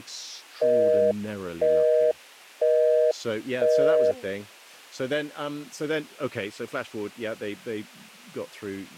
Telephone call progress tone (North American plan), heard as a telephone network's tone, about 480, 620 Hz, 0.5 s on and 0.5 s off, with speech in English. Busy tone.